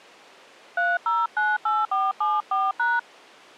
DTMF, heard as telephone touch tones, dialled by hand, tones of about 200 ms. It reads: 3098474#